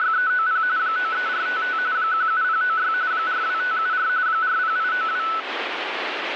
RTTY (45.45 baud, 170 Hz shift), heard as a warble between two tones, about 1400 Hz centre, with radio static. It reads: … 93455 17096 42574 40892